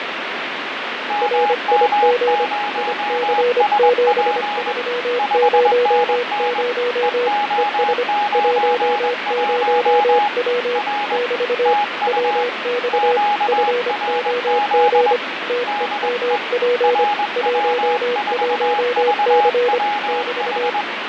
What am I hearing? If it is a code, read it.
Morse code, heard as two keyed tones, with radio static and fading. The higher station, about 21 wpm, 830 Hz: MM0SP 5NN EO91 R TU QRZ DE RW4VWH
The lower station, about 25 wpm, 490 Hz: RIG IC7300 ES 10W <BT> WX FOG TEMP 11C <BT>